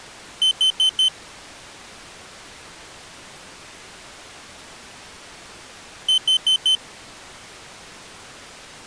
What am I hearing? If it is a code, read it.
Alarm pattern, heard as an alarm's beeps, played twice, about 3050 Hz. Temporal four. Carbon monoxide.